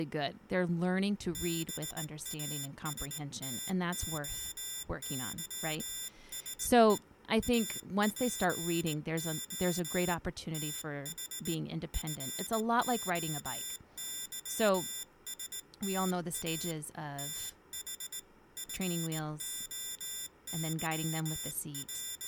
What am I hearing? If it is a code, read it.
Morse code (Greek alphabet), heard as a high beeper, hand-sent with a straight key, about 19 wpm, 3550 Hz, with speech in English. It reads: ΒΑΣΤΟΥΣΕ ΑΠΟ ΤΗ ΦΟΥΣΤΑ ΤΗ …